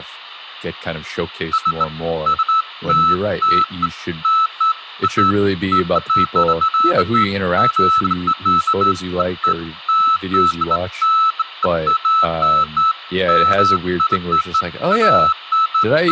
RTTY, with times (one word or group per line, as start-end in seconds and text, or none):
none